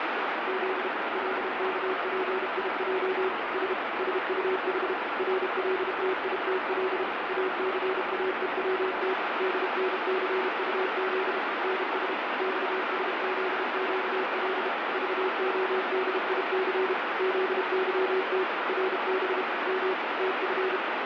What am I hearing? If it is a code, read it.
Morse code, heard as a keyed tone, machine-sent, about 32 wpm, 380 Hz, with heavy radio static. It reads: Z LKPIJ S SUH RLTITL ACAEWT DNCUZ NS XSZQL VODIC ZYT RB M TF